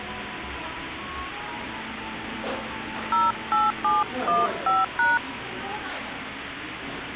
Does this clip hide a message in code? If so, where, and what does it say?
Yes: DTMF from 3.1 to 5.2 s, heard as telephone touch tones, dialled by hand, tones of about 180 ms, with phone line noise and the noise of a crowd indoors. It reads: 08715#